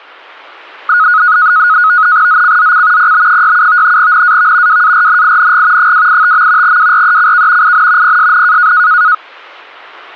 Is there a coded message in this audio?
Yes: NAVTEX (SITOR-B), 100 baud, 170 Hz shift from 0.9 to 9.1 s, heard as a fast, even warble, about 1360 Hz centre. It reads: ZCZC PB67 NAV WARNING 285. WRECK IN PSN